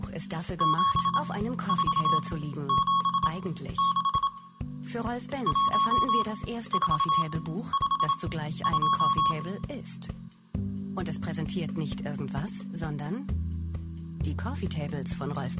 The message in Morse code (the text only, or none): 7476 1452